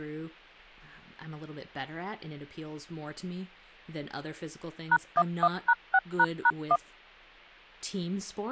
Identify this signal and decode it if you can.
DTMF, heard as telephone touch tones, dialled by machine, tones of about 50 ms, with hum and speech in English. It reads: #11#6##1